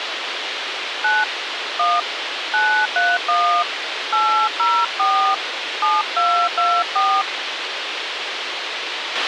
DTMF, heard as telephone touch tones, dialled by hand, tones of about 260 ms, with radio hiss and a squelch burst at the end. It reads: 9 1 931 804 7224